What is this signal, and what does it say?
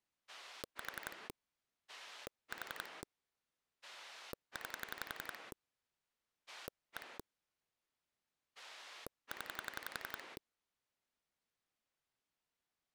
Pulse dialling, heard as a rotary dial, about 11 pulses a second. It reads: 4 4 9 1 0